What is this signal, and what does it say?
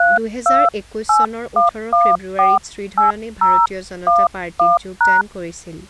DTMF, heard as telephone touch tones, dialled by hand, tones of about 190 ms, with speech in Assamese. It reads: 3281148011#